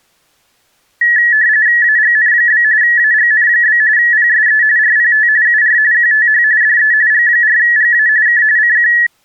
RTTY (45.45 baud, 170 Hz shift), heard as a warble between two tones, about 1800 Hz centre. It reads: AGN? AGN? PSE RPT UR QTH DE G4GA K CQ